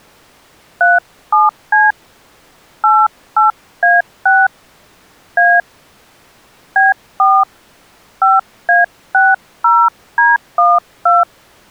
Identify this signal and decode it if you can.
DTMF, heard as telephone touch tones, dialled by hand, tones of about 190 ms. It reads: 37C 88A6 A B4 5A60D12